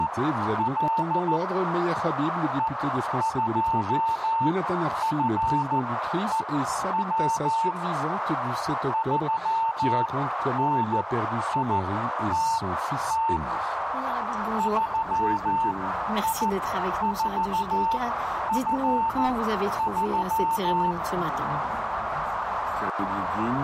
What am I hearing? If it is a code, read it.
Morse code, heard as a keyed tone, machine-sent, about 14 wpm, spaced as for 10 wpm, 900 Hz, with radio static and a narrow filter. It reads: … E2FEW 3NITT 3I4F3